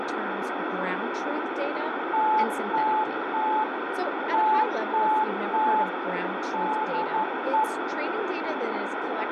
Morse code, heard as a keyed tone, machine-sent, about 12 wpm, 870 Hz, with heavy radio static and speech in English. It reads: TTT TTT DE